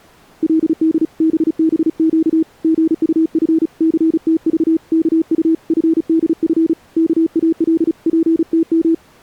Morse code (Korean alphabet), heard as a keyed tone, hand-sent with a paddle, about 35 wpm, 320 Hz. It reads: 그때 신철이는 옥점